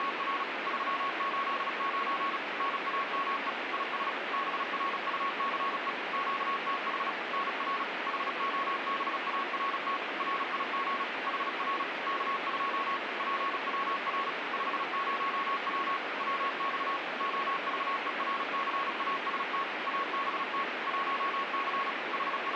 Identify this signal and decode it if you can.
Morse code, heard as a keyed tone, machine-sent, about 36 wpm, 1100 Hz, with radio static. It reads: … 389 NAME IS BRUCE QTH NR HOBART RIG HR K2 PWR 50W WX OVERCAST ABT 1C …